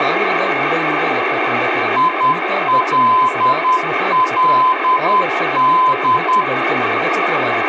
Morse code, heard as a keyed tone, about 10 wpm, 1020 Hz, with radio static and speech in Kannada. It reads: ILLD